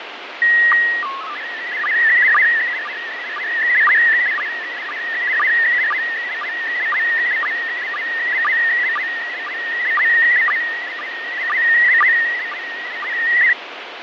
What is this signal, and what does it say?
SSTV (slow-scan television), PD 120, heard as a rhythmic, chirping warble, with heavy radio static and fading.